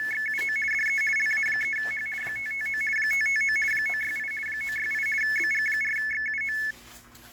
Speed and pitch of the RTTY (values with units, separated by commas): 50 baud, 450 Hz shift, 1950 Hz centre